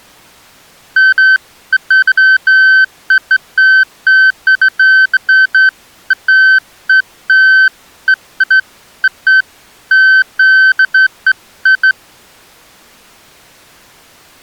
Beeps of irregular length. There is no code.